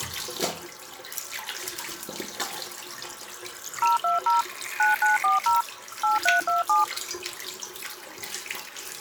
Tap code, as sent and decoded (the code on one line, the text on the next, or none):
none